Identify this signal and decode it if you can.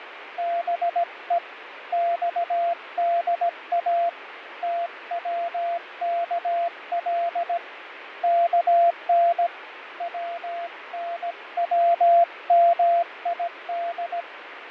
Morse code (Persian alphabet), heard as a keyed tone, hand-sent with a paddle, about 17 wpm, 690 Hz, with radio static and fading. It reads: به خدا توکل کن ونومید